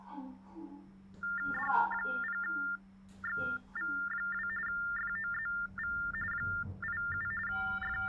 TTY/TDD text telephone tones (45.45 baud Baudot), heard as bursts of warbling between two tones, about 400 Hz shift, 1600 Hz centre, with the noise inside a lift. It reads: D0XV2 FOZV 87 …